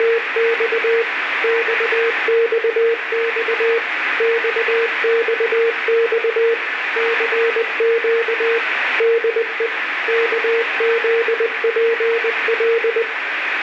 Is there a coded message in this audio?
Yes: Morse code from 0.0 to 13.1 s, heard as a keyed tone, machine-sent, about 20 wpm, 460 Hz, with radio static. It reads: … XXX XXX CQ DE KZPL